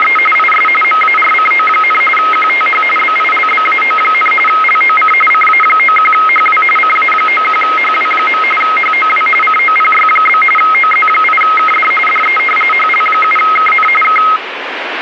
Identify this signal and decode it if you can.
RTTY (45.45 baud, 850 Hz shift), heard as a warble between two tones, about 1700 Hz centre, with radio static. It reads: … IS MARCO, QTH BILBAO, LOC CA91HW CA91HW. HOW COPY? OZ8KD DE HL7KN K